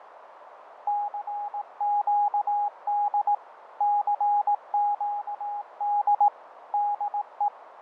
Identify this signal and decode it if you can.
Morse code, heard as a keyed tone, machine-sent, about 18 wpm, 820 Hz, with radio static, fading and a narrow filter. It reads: CQD CQD DE